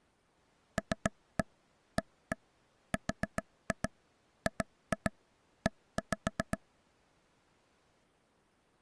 Tap code, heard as taps on a table, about 7 knocks a second. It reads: LARGE